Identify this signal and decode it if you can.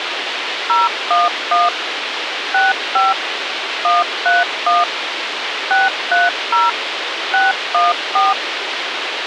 DTMF, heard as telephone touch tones, dialled by machine, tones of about 180 ms, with radio hiss. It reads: 011 65 131 630 614